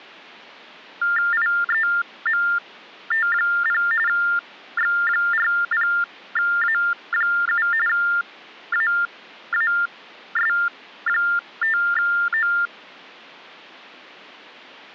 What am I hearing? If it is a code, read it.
TTY/TDD text telephone tones (45.45 baud Baudot), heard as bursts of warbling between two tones, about 400 Hz shift, 1600 Hz centre. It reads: IEMT0 X40A7 AAS5O